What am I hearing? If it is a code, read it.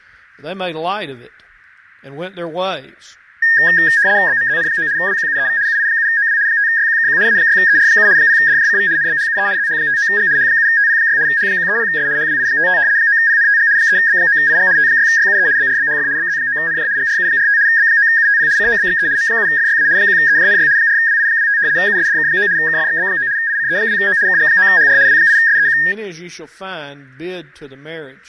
RTTY (75 baud, 170 Hz shift), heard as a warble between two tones, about 1750 Hz centre. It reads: BMZN9 WQUEV UI7OW 5YQKQ A6ER7 0DJCV NBHUE ZH59G H7TP6 H130S HWI55 9PNTG 3B9IG T6YUE BRBHF BZ9NJ GRU45 B9UTP COBXE M7FYA 1EJNY 4WI25 USDK9 KFXB9 ICE2O KG9HR W8SEQ